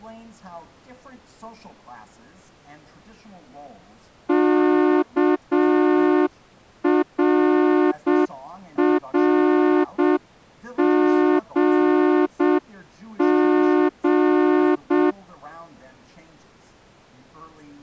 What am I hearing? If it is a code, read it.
Morse code, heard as a horn, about 7 wpm. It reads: KRRGG